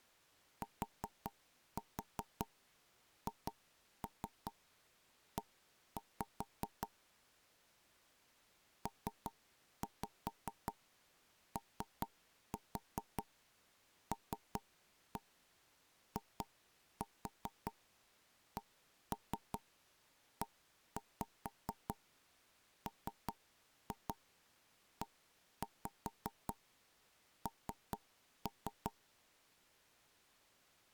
Tap code, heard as knocks on wood, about 5 knocks a second. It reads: THE POLICEMEN